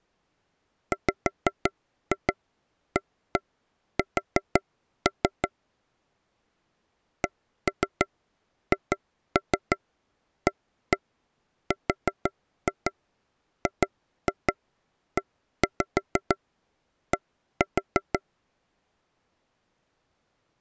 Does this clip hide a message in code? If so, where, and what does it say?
Yes: tap code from 0.9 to 18.2 s, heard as taps on a table, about 6 knocks a second. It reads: WAS CHARGED